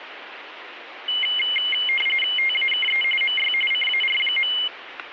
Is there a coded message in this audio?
Yes: RTTY (45.45 baud, 850 Hz shift) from 1.1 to 4.7 s, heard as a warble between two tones, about 2550 Hz centre, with radio static. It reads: TAKE MY CAR.